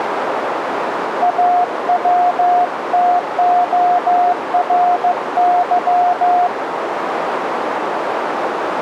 Morse code (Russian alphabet), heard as a keyed tone, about 15 wpm, 710 Hz, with radio static and a narrow filter. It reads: АВТОРЫ